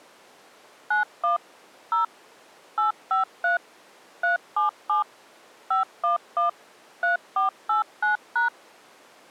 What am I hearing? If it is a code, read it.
DTMF, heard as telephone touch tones, dialled by machine, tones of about 130 ms. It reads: 91 0 853 377 511 3489#